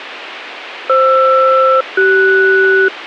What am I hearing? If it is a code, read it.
Aircraft SELCAL, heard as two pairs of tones, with radio hiss. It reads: FR-CS